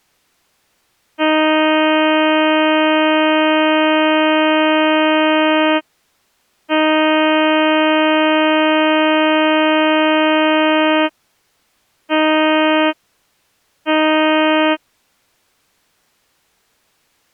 Ship horn signal, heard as a ship's horn, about 310 Hz. 2 long, 2 short. At sea: I intend to overtake on your port side.